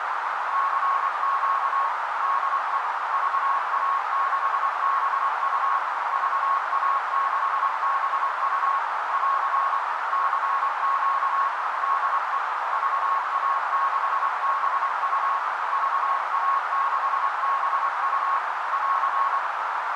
Morse code, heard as a keyed tone, machine-sent, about 24 wpm, 1100 Hz, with heavy radio static and a narrow filter. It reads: CQ DE VA6BU VA6BU <AR> CQ DE VA6BU VA6BU <AR>